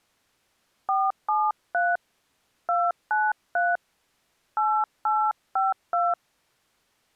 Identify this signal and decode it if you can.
DTMF, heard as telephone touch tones, dialled by hand, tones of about 220 ms. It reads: 473 293 8852